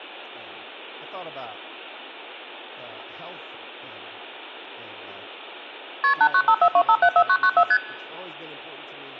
Multi-frequency trunk signalling (R1, as on North American trunks), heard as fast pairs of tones, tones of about 70 ms, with speech in English. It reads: KP 89542574994 ST